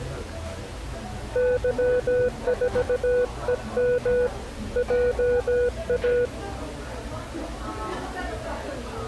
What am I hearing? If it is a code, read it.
Morse code, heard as a keyed tone, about 17 wpm, 490 Hz, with the noise of a cafe. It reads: Y4EM JA